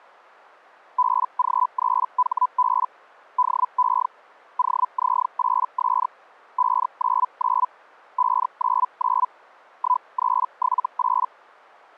Hellschreiber (Feld-Hell, 122.5 baud), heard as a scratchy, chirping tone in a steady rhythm, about 1000 Hz. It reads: BG3HB DE OZ8S 599 599 1378